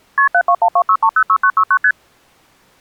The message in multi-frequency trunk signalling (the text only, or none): KP 72126306969 ST